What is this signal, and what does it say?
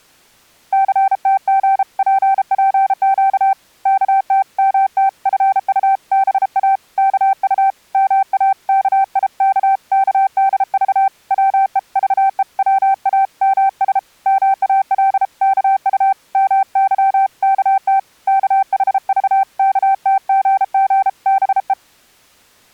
Morse code (Korean alphabet), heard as a keyed tone, hand-sent with a paddle, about 33 wpm, 780 Hz. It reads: 첫째 어머니도 이 모양을 바라보며 목이 메어 울었다